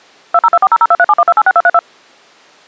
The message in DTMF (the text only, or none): 2024002371286232